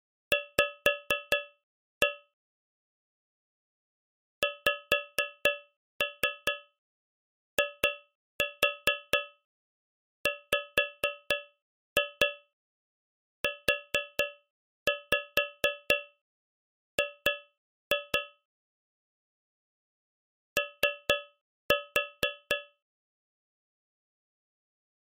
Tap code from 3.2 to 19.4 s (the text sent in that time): XIWUG